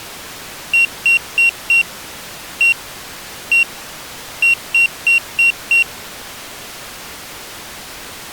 Beep code, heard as a piezo beeper, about 2750 Hz. 4-1-1-5.